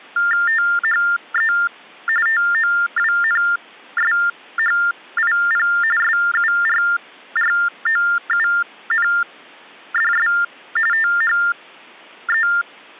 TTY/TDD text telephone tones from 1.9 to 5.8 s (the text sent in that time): TOWNSHIP